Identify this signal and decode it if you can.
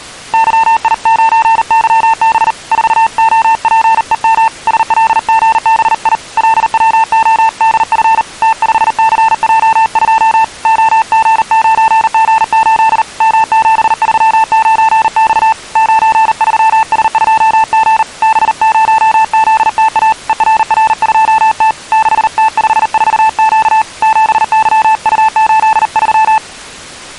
Morse code, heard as a keyed tone, hand-sent with a paddle, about 39 wpm, 890 Hz. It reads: YI9YB 4OPEM SLGBI LWODF T5CJ2 OG9G8 M739X 93S2G B0ZTA ERR2T 6T54Q 7YU83